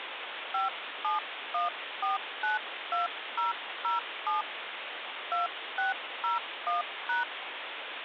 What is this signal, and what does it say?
DTMF, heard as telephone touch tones, dialled by hand, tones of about 140 ms, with phone line noise. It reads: 571492007 2601#